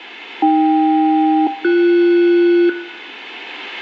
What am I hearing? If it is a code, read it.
Aircraft SELCAL, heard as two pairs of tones, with room echo. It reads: AK-BS